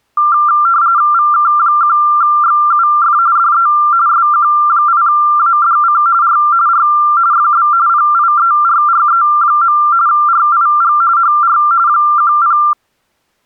RTTY (45.45 baud, 170 Hz shift), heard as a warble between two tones, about 1280 Hz centre. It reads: VK1XUF DE SQ8ADC R R FB PIERRE. RIG HR 10